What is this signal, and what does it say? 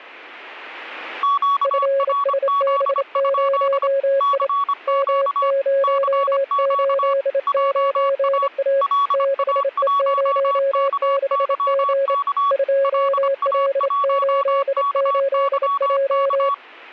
Morse code, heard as two keyed tones. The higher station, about 25 wpm, 1120 Hz: QRZ? CQ CQ JA LA1KYK LA1KYK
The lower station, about 28 wpm, 550 Hz: FSB0I M089A 6E06G 2L88J